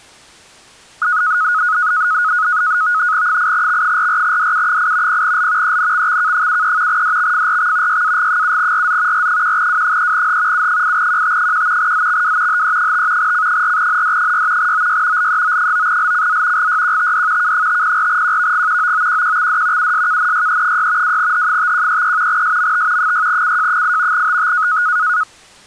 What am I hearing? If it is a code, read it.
NAVTEX (SITOR-B), 100 baud, 170 Hz shift, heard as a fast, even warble, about 1360 Hz centre. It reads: 8X44DU8 0L ENXXK73 DXFRX YAG7RZ R1W3H U8QT1 ZXW HE5 C4ND6 OY LEO9LCZ GYQTD K504QVG OOQQXD USKNYE6 2H5133 SMT 6CJ8 TT